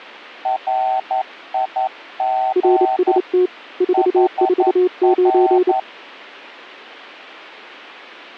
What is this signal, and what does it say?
Morse code, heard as two keyed tones. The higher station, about 11 wpm, 760 Hz: RIG HR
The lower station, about 28 wpm, 360 Hz: RST 449